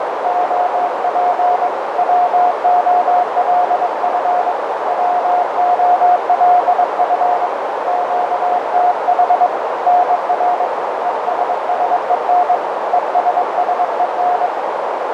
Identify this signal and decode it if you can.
Morse code, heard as a keyed tone, hand-sent with a bug key, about 22 wpm, 720 Hz, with heavy radio static and a narrow filter. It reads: OP WOLF WOLF QTH NR ESSEN ESSEN